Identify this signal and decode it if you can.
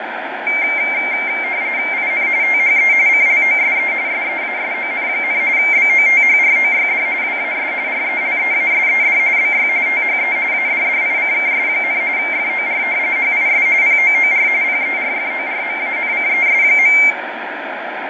RTTY (45.45 baud, 170 Hz shift), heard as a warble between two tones, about 2200 Hz centre, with radio static and fading. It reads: IN THE CLOSE SEASON, BOTHROYD WAS RELEASED BY THE ADDICKS, FOR HIS POOR PERFORMANCES.